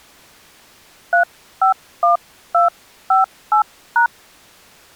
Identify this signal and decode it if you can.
DTMF, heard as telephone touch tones, dialled by hand, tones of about 130 ms. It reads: 351258#